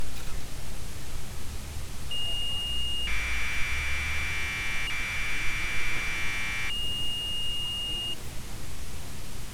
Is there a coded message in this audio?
Yes: Commodore tape loading (standard loader) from 2.1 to 8.1 s, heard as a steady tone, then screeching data, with tape hiss and street noise.